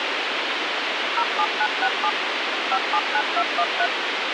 DTMF, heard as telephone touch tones, dialled by machine, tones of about 60 ms, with radio hiss. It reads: 07967 579213